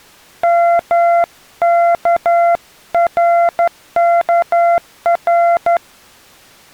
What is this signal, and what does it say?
Morse code, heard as a keyed tone, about 12 wpm, 690 Hz. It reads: MKRKR